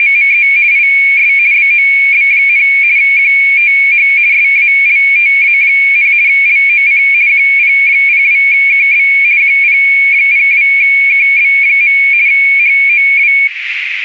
RTTY (50 baud, 170 Hz shift), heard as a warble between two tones, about 2300 Hz centre, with radio static and a narrow filter. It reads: … IS BOB, QTH SALTA, LOC QP02KB QP02KB. HOW